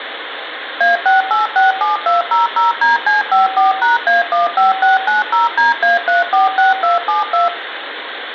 DTMF, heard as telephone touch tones, dialled by machine, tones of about 150 ms, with phone line noise and room echo. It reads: A6867200DC54#A15690DA346272